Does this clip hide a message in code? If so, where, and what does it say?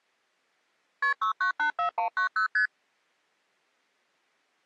Yes: multi-frequency trunk signalling (R1, as on North American trunks) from 1.0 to 2.7 s, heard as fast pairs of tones, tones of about 100 ms. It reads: KP 6984190 ST